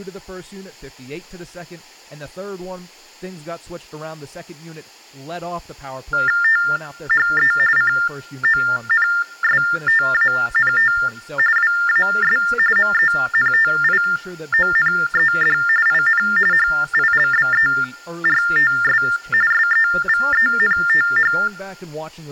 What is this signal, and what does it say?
TTY/TDD text telephone tones (45.45 baud Baudot), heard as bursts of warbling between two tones, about 400 Hz shift, 1600 Hz centre, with speech in English. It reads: THE CONSTANT WAS MENTIONED IN HILBERTS SEVENTH